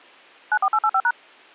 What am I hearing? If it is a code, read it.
DTMF, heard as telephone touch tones, dialled by machine, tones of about 60 ms. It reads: 94885#